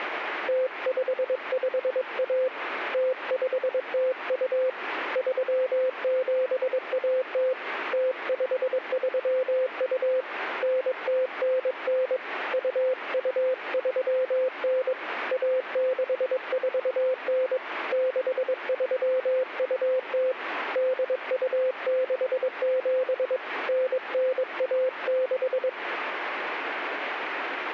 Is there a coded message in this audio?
Yes: Morse code (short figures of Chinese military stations) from 0.4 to 25.8 s, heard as a keyed tone, hand-sent with a paddle, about 22 wpm, 520 Hz, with radio static. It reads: 0551 0502 3710 0532 9099 2239 1649 6320 8267 9916